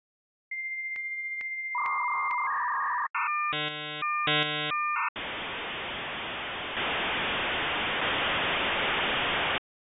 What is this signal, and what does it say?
Dial-up modem handshake (V.34 or later), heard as a whistle, warbles, then hiss.